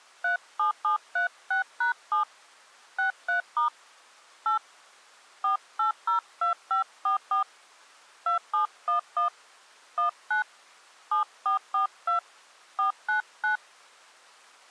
DTMF, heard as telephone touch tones, dialled by hand, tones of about 120 ms. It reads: 37736#7 63* 8 4802544 2711 19 7442 499